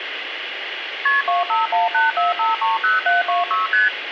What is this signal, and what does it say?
Multi-frequency trunk signalling (R1, as on North American trunks), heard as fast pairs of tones, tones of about 160 ms, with phone line noise. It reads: KP 25184530726 ST